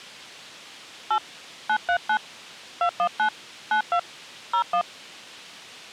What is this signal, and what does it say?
DTMF, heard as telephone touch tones, dialled by hand, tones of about 80 ms. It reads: 8 939 219 92 01